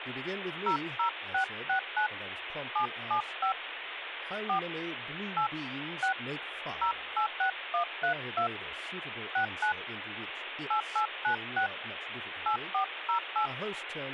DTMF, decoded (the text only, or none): 00669 775 4 8 6 086132 69 8896 8408